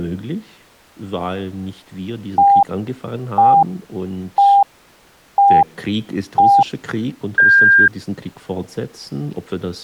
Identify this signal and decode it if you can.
Radio time signal (five pips and a higher one, as on Chinese radio), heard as pips.